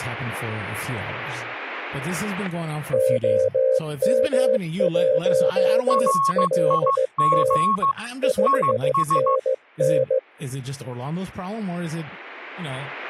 Morse code, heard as two keyed tones, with static crashes and speech in English. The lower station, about 16 wpm, 520 Hz: OM1LT 5NN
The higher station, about 15 wpm, 1100 Hz: RIG IS